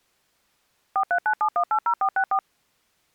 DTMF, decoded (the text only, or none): 4397180464